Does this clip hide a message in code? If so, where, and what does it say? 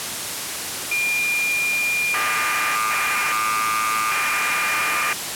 Yes: cassette data (Kansas City type), 1200 baud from 0.9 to 5.1 s, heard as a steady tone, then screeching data, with tape hiss.